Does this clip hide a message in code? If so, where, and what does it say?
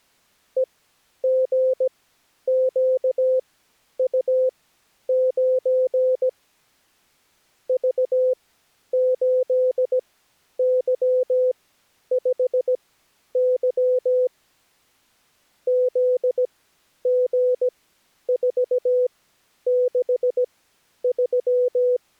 Yes: Morse code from 0.5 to 22.0 s, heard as a keyed tone, machine-sent, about 17 wpm, spaced as for 10 wpm, 510 Hz. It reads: EGQU9 V8Y5Y ZG463